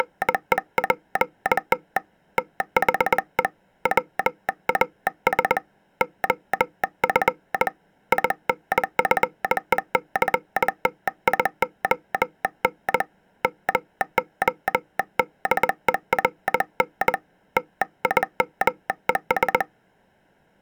Morse code, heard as a telegraph sounder, hand-sent with a bug key, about 20 wpm. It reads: … THE WAS OF INFECTION MODERN TIMES